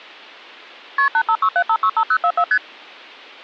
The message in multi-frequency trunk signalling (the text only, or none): KP 8567565044 ST